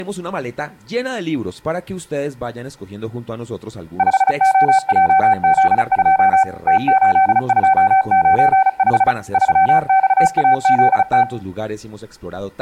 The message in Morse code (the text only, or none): 5OJZ2 T8295 3XAZT